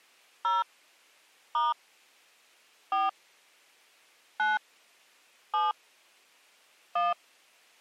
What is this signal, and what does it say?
DTMF, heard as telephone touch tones, dialled by hand, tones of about 180 ms. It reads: 0 * 4 9 7 1